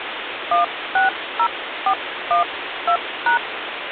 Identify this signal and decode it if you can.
DTMF, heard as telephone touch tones, dialled by hand, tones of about 120 ms, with phone line noise. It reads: 160412#